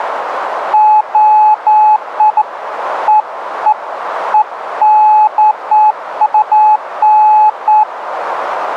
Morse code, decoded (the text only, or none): none